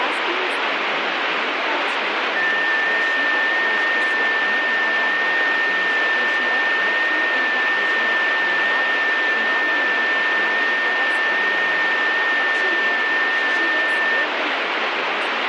FT8 (one signal), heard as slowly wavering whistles, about 6.25 baud, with radio static and speech in Sanskrit.